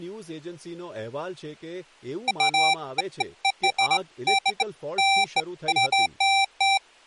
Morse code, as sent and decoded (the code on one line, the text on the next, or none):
none